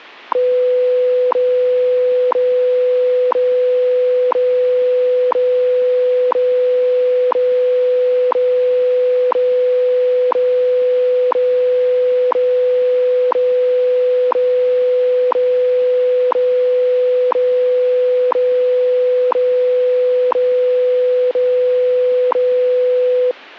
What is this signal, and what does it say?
Radio time signal (WWV, Colorado), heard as ticks, one a second.